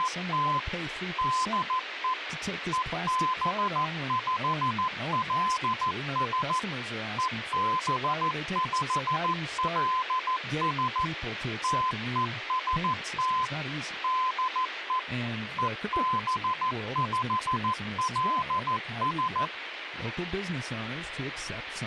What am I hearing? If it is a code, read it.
Morse code, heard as a keyed tone, machine-sent, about 14 wpm, 1020 Hz, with radio hiss and speech in English. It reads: … DE EB5LS EB5LS TEST DE EB5LS